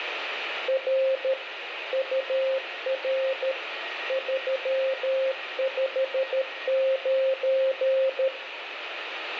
Morse code, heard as a keyed tone, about 13 wpm, 530 Hz, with radio static and room echo. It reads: R UR 359